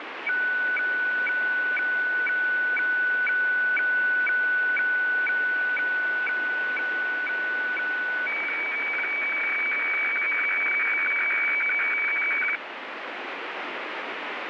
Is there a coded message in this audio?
Yes: weather fax (radiofax), 120 lines a minute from 0.3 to 12.6 s, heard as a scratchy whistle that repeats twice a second, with radio static.